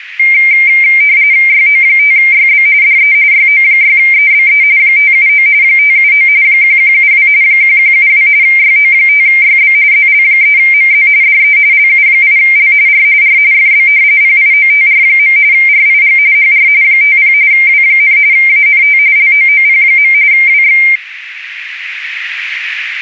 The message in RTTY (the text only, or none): YO5YB DE YO6EBE 579 579 1172 1172 YO5YB ZL3MZ DE LU8L R R FB PIOTR. RIG HR 50 W, ANT LOOP. WX